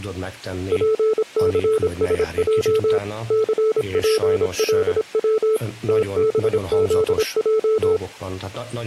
Morse code, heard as a keyed tone, machine-sent, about 26 wpm, 440 Hz, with speech in Hungarian. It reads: PCSJ CPLW TBZJ